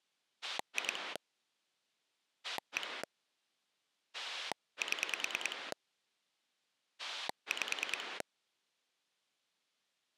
Pulse dialling, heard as a rotary dial, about 9 pulses a second. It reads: 2 1 7 5